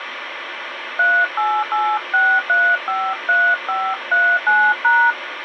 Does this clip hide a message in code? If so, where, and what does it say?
Yes: DTMF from 1.0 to 5.1 s, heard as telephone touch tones, dialled by hand, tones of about 260 ms, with radio hiss. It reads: 3886353539#